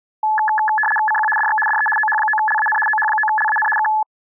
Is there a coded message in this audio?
Yes: RTTY (75 baud, 850 Hz shift) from 0.2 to 4.0 s, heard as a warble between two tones, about 1290 Hz centre. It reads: CQ DX DE OH9LAN OH9LAN K